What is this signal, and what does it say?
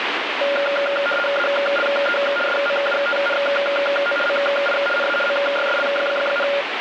RTTY (75 baud, 850 Hz shift), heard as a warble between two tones, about 990 Hz centre, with radio static. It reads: ALE SMUTNO MI NA MYSL,